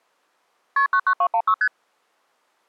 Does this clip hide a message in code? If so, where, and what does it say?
Yes: multi-frequency trunk signalling (R1, as on North American trunks) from 0.8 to 1.7 s, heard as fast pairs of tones, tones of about 70 ms. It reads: KP 99216 ST